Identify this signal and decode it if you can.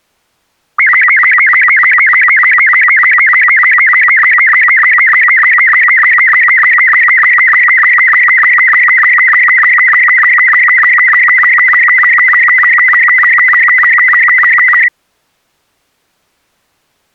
SSTV (slow-scan television), Robot 36, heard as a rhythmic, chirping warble.